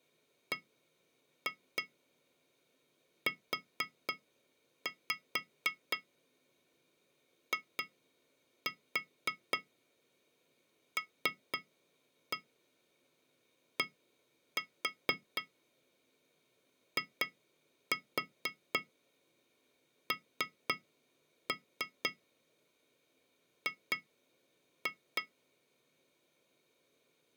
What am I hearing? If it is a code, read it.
Tap code, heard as taps on glass, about 4 knocks a second. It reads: BUILDING